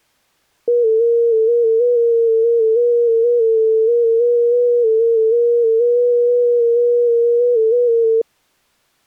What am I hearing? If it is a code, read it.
FT8 (one signal), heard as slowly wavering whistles, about 6.25 baud.